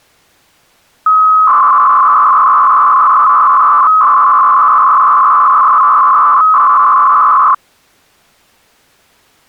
300-baud modem data (Bell 103 tones), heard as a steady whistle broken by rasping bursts, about 300 baud, 200 Hz shift.